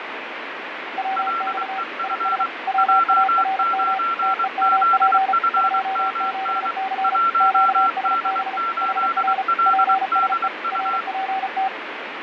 Morse code, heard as two keyed tones, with radio static and fading. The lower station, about 34 wpm, 770 Hz: WX IS WARM TEMP 27C QSB HR PSE RPT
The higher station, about 23 wpm, 1360 Hz: LEF J9ZFMN 1D8LDU